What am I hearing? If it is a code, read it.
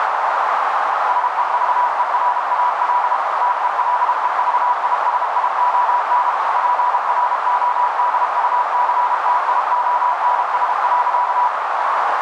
Morse code, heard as a keyed tone, machine-sent, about 32 wpm, 980 Hz, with heavy radio static and a narrow filter. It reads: SEVERAL TELEVISION PRODUCTIONS.